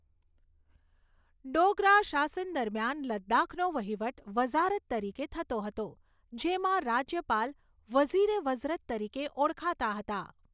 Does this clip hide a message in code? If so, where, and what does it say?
No, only speech in Gujarati.